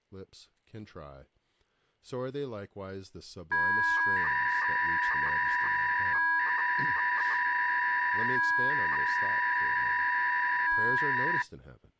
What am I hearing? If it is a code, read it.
300-baud modem data (V.21 tones), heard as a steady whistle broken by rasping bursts, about 300 baud, 200 Hz shift, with speech in English.